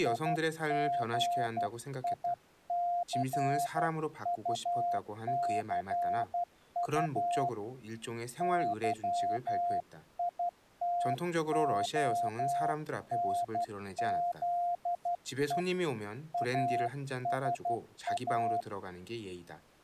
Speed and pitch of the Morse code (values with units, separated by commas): 12 wpm, 700 Hz